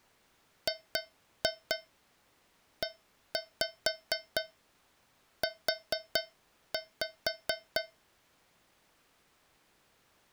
Tap code, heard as taps on a metal pipe, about 4 knocks a second. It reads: GEU